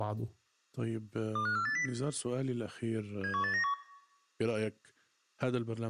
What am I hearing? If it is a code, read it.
Five-tone selective call (CCIR), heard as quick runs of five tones, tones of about 100 ms, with room echo and speech in Arabic. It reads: 25480 71891